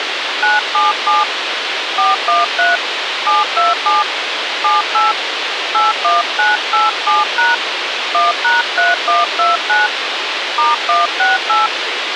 DTMF, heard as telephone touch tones, dialled by hand, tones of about 170 ms, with radio hiss. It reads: 977 413 727 78 81987# 1#3129 *168